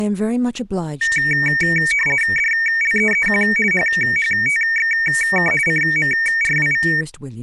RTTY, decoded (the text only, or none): DLEEQ HHTXK CMRWV